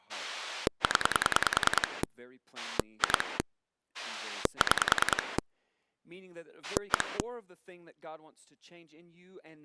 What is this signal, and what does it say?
Pulse dialling, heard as a rotary dial, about 10 pulses a second, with speech in English. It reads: 0 2 6 1